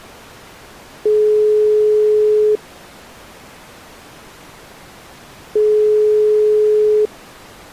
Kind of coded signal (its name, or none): telephone call progress tone